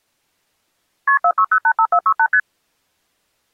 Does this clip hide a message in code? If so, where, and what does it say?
Yes: multi-frequency trunk signalling (R1, as on North American trunks) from 1.1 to 2.4 s, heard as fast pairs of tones, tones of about 70 ms. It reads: KP 46085468 ST